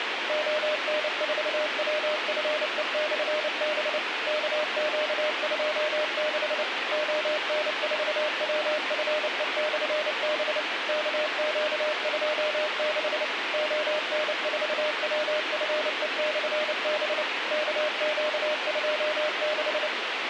Morse code, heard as a keyed tone, machine-sent, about 29 wpm, 610 Hz, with radio hiss. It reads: ON4WFE/B KQ26 ON4WFE/B KQ26 ON4WFE/B KQ26